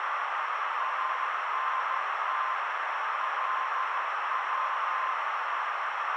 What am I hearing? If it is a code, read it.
Morse code, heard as a keyed tone, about 13 wpm, 1040 Hz, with heavy radio static and a narrow filter. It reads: ANT LW